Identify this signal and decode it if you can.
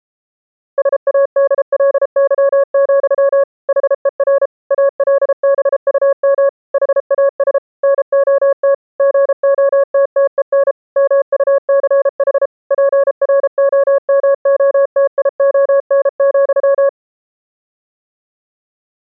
Morse code, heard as a keyed tone, machine-sent, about 33 wpm, 560 Hz. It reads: SADLY, HER ALBUM HAS NOT GOTTEN MUCH PROMOTION,